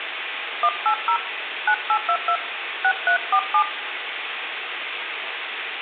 DTMF, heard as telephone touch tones, dialled by hand, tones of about 80 ms, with phone line noise and room echo. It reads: 180 9822 6347